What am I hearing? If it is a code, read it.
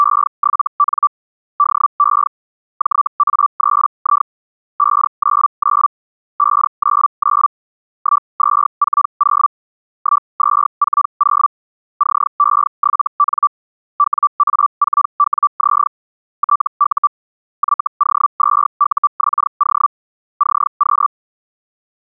Hellschreiber (Feld-Hell, 122.5 baud), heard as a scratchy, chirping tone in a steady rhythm, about 1160 Hz. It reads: … DE JA3I 599 599 1240 1240 CE7N WA4WZ TU YO2UXO CQ